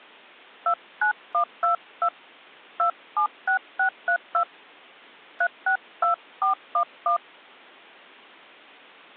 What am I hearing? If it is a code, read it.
DTMF, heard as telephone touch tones, dialled by hand, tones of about 90 ms. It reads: 29122 276632 362411